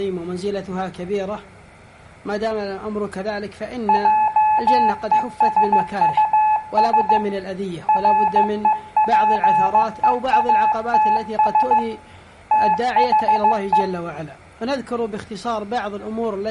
Morse code, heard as a keyed tone, hand-sent with a paddle, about 15 wpm, 860 Hz, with room echo. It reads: JESUS REPEATS THE